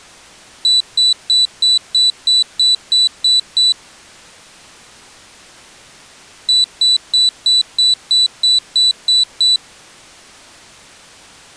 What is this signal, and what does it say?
Beep code, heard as a piezo beeper, played twice, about 3950 Hz. 10 short. In AMI BIOS tables: CMOS shutdown register error.